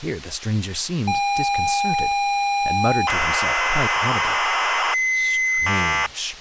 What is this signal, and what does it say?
ZX Spectrum tape loading, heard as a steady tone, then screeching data, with speech in English.